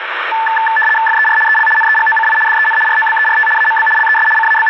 RTTY (75 baud, 850 Hz shift), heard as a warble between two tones, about 1320 Hz centre, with radio static. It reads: FER EL NEGOCI DEN ROBERT AMB LES …